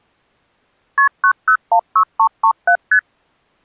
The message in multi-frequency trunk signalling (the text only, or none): KP 9016337 ST